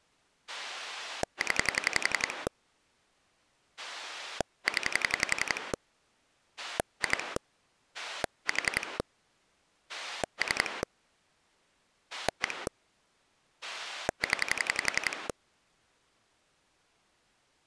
Pulse dialling, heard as a rotary dial, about 11 pulses a second. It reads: 0 0 2 4 3 1 0